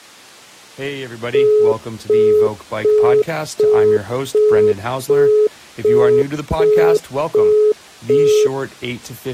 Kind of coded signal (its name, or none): telephone call progress tone